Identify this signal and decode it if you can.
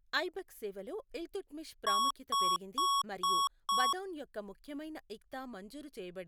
Beep code, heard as beeps from a small speaker, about 1110 Hz, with speech in Telugu. 5 short. In AMI BIOS tables: processor failure; in Dell tables: CMOS battery failure.